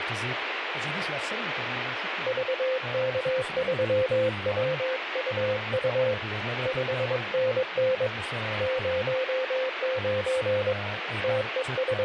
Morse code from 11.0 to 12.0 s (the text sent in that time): …